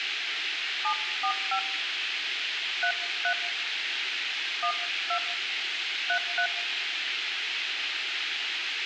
DTMF, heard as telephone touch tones, dialled by hand, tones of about 80 ms, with radio hiss and room echo. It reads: 745 33 12 33